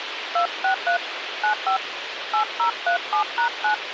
DTMF, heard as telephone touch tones, dialled by hand, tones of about 100 ms, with radio hiss. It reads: 263 95 8037#9